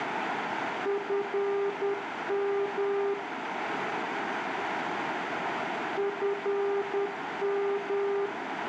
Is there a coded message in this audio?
Yes: Morse code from 0.8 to 8.3 s, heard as a keyed tone, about 10 wpm, 400 Hz, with radio static, a narrow filter and room echo. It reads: FM FM